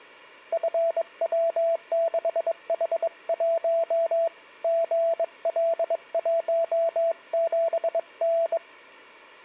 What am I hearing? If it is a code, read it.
Morse code, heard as a keyed tone, hand-sent with a bug key, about 22 wpm, 670 Hz. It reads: FW6H1 GL17N